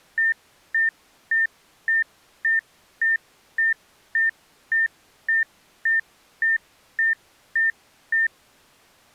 Evenly repeated beeps. There is no code.